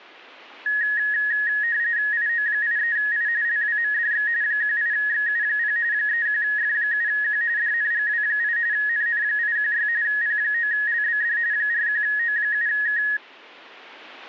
RTTY (45.45 baud, 170 Hz shift), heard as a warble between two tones, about 1800 Hz centre. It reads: IO83I LWMDX 18XU0 31F7Q DNGW8 NN816 P9LBD 41O7K